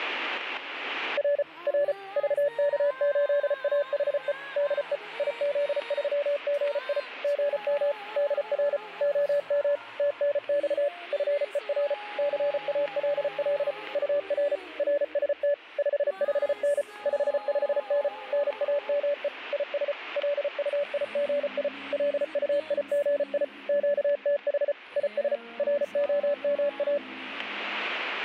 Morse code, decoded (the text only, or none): R R VK8AHE DE IZ3GI GM DR OM TNX FER CALL UR RST 55N 55N NAME IS LUIGI LUIGI QTH IS ROMA